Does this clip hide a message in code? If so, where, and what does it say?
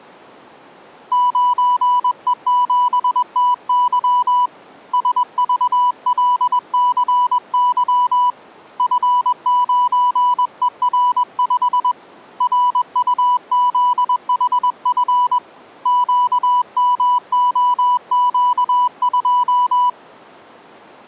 Yes: Morse code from 1.1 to 20.0 s, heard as a keyed tone, hand-sent with a paddle, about 21 wpm, 990 Hz. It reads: 9E7TY SVLCY F9ER5 RUZHF QMOQ2